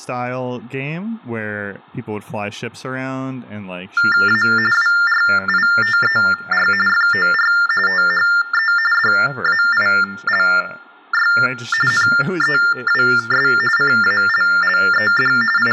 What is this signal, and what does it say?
TTY/TDD text telephone tones (45.45 baud Baudot), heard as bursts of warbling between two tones, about 400 Hz shift, 1600 Hz centre, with room echo and speech in English. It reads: A WRITER FOR THE DAILY NEWS CALLED …